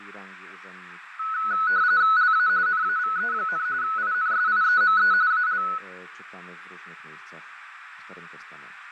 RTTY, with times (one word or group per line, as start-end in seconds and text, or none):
2.2-2.5 LA
2.7-3.7 NAVE,
3.8-5.1 INSIEME
5.3-5.6 AL